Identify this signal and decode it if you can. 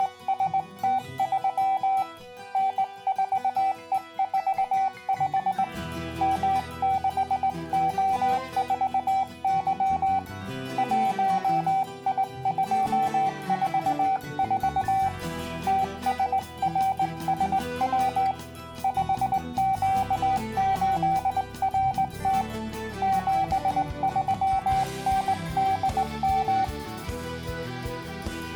Morse code, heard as a keyed tone, hand-sent with a straight key, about 19 wpm, 770 Hz. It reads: … N4E45 M6O4Y 1I244 TSRSW 5Q8RT 73NDM